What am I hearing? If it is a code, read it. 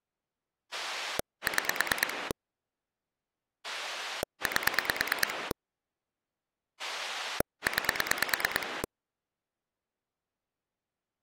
Pulse dialling, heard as a rotary dial, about 9 pulses a second. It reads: 6 8 9